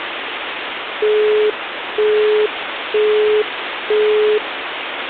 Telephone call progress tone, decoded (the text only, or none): busy tone